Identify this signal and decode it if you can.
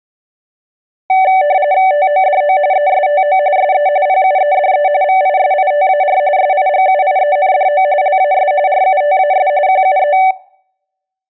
RTTY (45.45 baud, 170 Hz shift), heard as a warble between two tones, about 670 Hz centre. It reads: TODO ESTO SE PUEDE VISITAR SIGUIENDO LAS RUTAS QUE